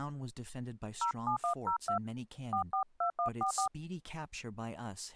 DTMF, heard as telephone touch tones, dialled by hand, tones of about 100 ms, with speech in English. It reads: 07102 442144